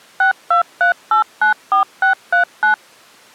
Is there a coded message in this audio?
Yes: DTMF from 0.2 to 2.7 s, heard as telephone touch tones, dialled by machine, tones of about 110 ms. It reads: 623894639